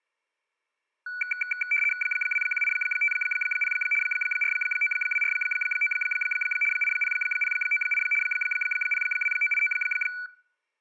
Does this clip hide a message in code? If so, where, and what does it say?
Yes: RTTY (75 baud, 850 Hz shift) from 1.1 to 10.3 s, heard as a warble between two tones, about 1900 Hz centre. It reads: 21850 49249 80098 02989